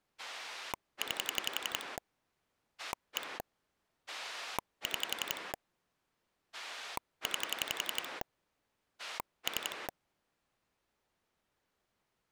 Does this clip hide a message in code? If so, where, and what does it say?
Yes: pulse dialling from 0.2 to 9.9 s, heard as a rotary dial, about 11 pulses a second. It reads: 9 1 6 9 3